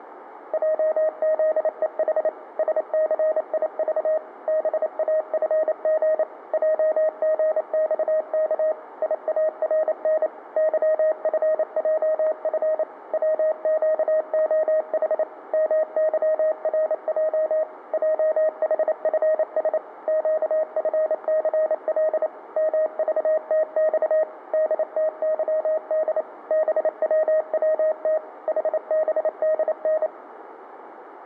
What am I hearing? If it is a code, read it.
Morse code, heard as a keyed tone, machine-sent, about 28 wpm, 630 Hz, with room echo. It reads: JZEH SCIV BAFG JGXK IARN YFJF WQOH MYRJ JHFS QFCL MVTX DTYD BWWT HBDN